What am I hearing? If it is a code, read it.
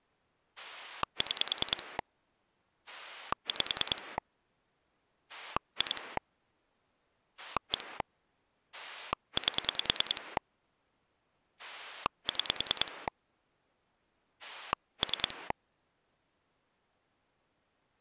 Pulse dialling, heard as a rotary dial, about 10 pulses a second. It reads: 6 5 2 1 8 6 3